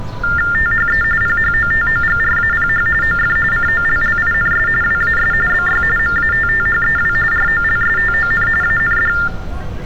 TTY/TDD text telephone tones (45.45 baud Baudot), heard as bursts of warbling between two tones, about 400 Hz shift, 1600 Hz centre, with street noise. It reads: THE PHOTOGRAPH OF COLLINS WAS BY MATTHEW ROLSTON AND